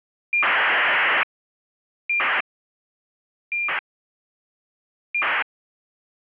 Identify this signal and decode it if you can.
ACARS aircraft data, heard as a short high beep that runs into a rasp, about 2400 baud.